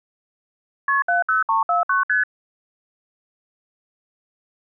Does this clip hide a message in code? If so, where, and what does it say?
Yes: multi-frequency trunk signalling (R1, as on North American trunks) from 0.9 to 2.2 s, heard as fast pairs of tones, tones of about 140 ms. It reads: KP 70349 ST